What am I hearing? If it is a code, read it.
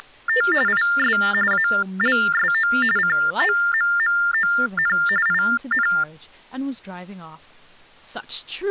TTY/TDD text telephone tones (45.45 baud Baudot), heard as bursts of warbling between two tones, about 400 Hz shift, 1600 Hz centre, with speech in English. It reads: … IS ALSO COMMON IN